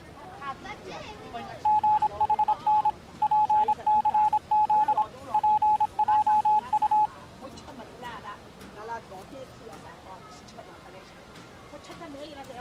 Morse code, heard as a keyed tone, machine-sent, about 26 wpm, 850 Hz. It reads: GHN PCZ PJU